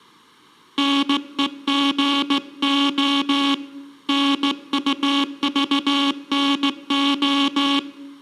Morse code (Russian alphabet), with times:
0.8-3.5 НЕГО
4.1-7.8 НУЖНО

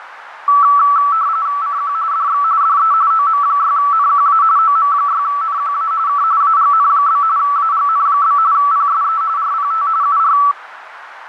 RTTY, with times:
1.6-1.9 CQ
2.1-2.4 DX
2.6-2.9 DE
3.1-4.4 OM6NQA
4.6-5.9 OM6NQA
6.1-6.2 K
6.4-7.2 AGN?
7.4-8.4 AGN?
8.5-9.2 PSE
9.4-9.9 RPT
10.0-10.4 UR

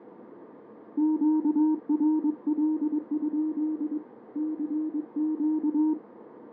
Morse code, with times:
1.0-4.0 QRL?
4.4-5.9 CQ

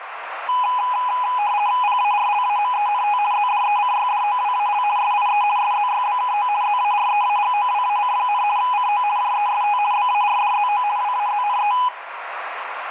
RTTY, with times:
1.8-3.2 PARLAMENT
3.3-4.8 ZDECYDOWAL
5.0-5.4 SIE
5.6-6.5 SZYBKO
6.6-8.4 ZAREAGOWAC,
8.6-9.0 CO
9.2-9.8 JEST
9.9-10.8 BARDZO
11.0-11.7 WAZNE

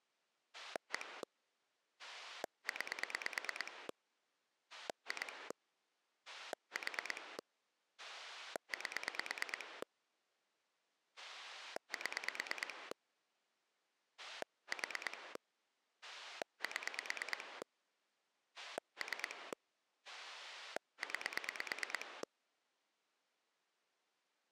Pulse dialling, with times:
0.5-1.2 1
2.0-3.9 9
4.7-5.5 2
6.3-7.4 4
8.0-9.8 8
11.2-12.9 7
14.2-15.4 4
16.0-17.6 7
18.6-19.5 3
20.1-22.2 9

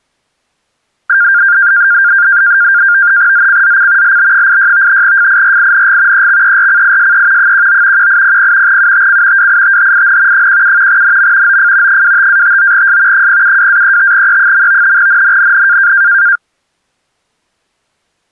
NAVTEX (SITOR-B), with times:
3.3-4.2 ZCZC
4.0-5.0 LB86
5.0-6.3 FIRING
6.1-7.5 EXERCISE
7.4-8.1 19
8.0-8.8 1800
8.7-9.5 UTC
9.4-10.5 WITHIN
10.3-11.0 17
10.9-11.6 NM
11.5-12.0 OF
11.9-13.3 25-59S
13.1-15.0 072-35E.
15.0-15.9 NNNN

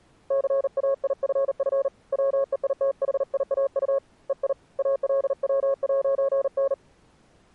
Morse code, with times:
0.3-1.9 CAIFF
2.1-4.0 WEITHIAU
4.3-4.5 EI
4.8-6.7 ALW'N

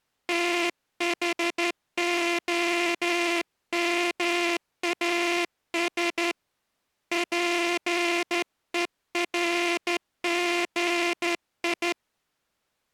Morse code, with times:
0.3-6.3 THOMAS
7.1-11.9 PERGI

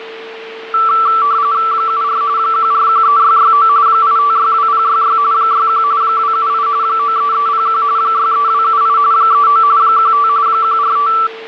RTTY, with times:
1.7-2.2 74
2.4-3.7 1413669
3.9-5.2 8562066
5.3-5.8 61
6.0-6.7 278
6.8-7.8 93301
8.0-9.0 63278
9.1-9.6 39
9.8-10.3 15
10.5-11.1 145

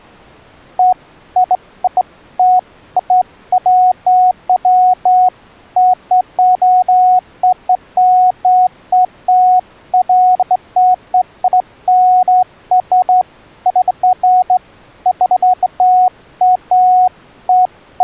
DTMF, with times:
none

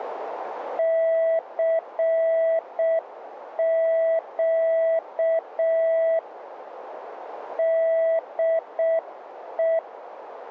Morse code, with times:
0.8-6.2 CQ
7.6-9.8 DE

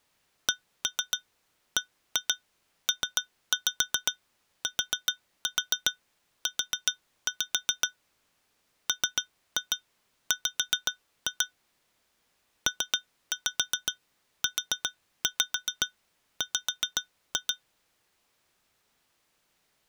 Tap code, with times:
0.5-7.9 CBPTU
8.9-11.5 MW
12.7-17.5 PUW

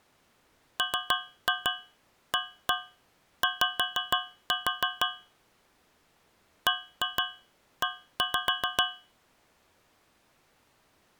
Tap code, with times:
0.8-5.1 MAY
6.7-8.8 BE

